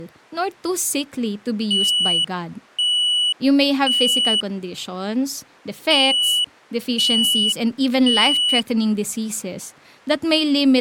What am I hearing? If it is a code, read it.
Alarm pattern, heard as an alarm's beeps, played twice, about 2950 Hz, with speech in Filipino. Temporal three. Smoke or fire, evacuate.